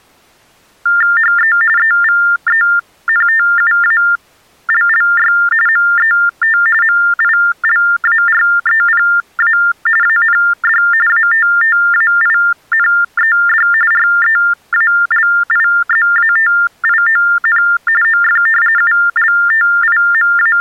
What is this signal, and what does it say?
TTY/TDD text telephone tones (45.45 baud Baudot), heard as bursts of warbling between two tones, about 400 Hz shift, 1600 Hz centre. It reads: HE EVENTUALLY MET MILAREPA AND ATTAINED REALIZATION OF …